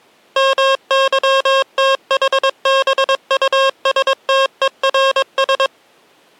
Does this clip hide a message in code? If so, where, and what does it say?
Yes: Morse code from 0.3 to 5.7 s, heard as electronic beeps, machine-sent, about 22 wpm, 540 Hz. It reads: MYTHBUSTERS